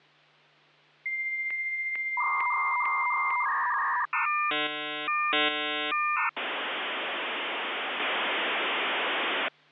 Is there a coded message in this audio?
Yes: dial-up modem handshake (V.34 or later) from 1.1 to 9.5 s, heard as a whistle, warbles, then hiss, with hum.